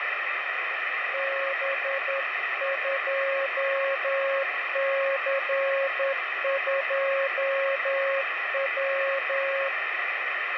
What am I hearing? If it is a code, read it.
Morse code, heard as a keyed tone, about 10 wpm, 550 Hz, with heavy radio static. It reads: B2C2W